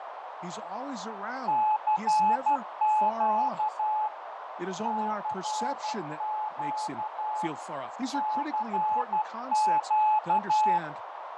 Morse code, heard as a keyed tone, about 12 wpm, 860 Hz, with heavy radio static, fading, a narrow filter and speech in English. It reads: CQ CQ CQ